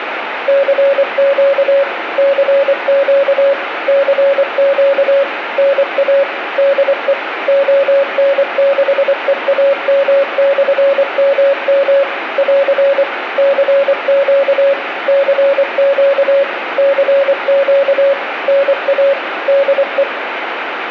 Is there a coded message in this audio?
Yes: Morse code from 0.4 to 20.1 s, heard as a keyed tone, machine-sent, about 24 wpm, 560 Hz, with radio static and room echo. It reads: CQ CQ CQ NA DE ON6EAM/MM <AR> CQ CQ CQ NA DE